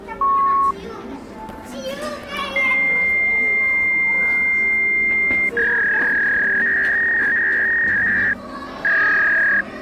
Fax machine handshake, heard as a beep, a long tone and a warble, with the noise of a cafe.